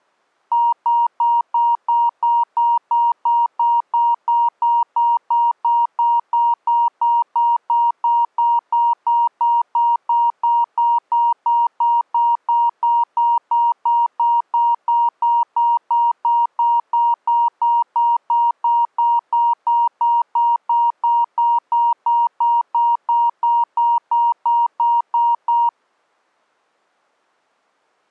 Evenly repeated beeps. There is no code.